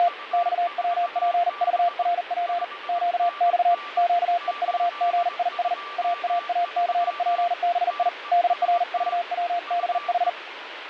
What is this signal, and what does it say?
Morse code, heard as a keyed tone, hand-sent with a paddle, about 40 wpm, 690 Hz, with radio static and a weaker station near 1170 Hz. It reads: … XWPVRP QX QEVGIS AAACPBI DRVWBH